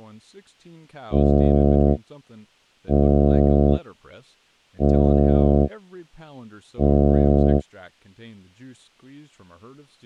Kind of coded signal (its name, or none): ship horn signal